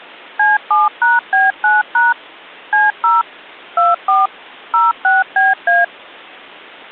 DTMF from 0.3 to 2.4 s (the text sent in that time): C7#B9#